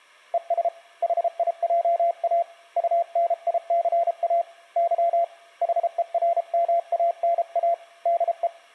Morse code, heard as a keyed tone, hand-sent with a paddle, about 33 wpm, 680 Hz. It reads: ES HIJA UNICA Y HERMANA DE